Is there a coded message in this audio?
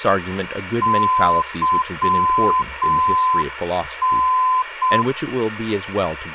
Yes: Morse code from 0.8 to 5.1 s, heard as a keyed tone, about 6 wpm, 1020 Hz, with radio hiss, room echo and speech in English. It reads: YN